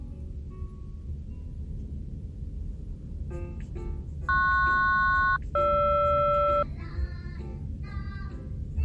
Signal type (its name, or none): aircraft SELCAL